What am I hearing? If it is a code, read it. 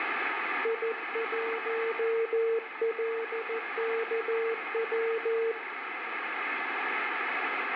Morse code, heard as a keyed tone, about 14 wpm, 460 Hz, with radio static. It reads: I1LKW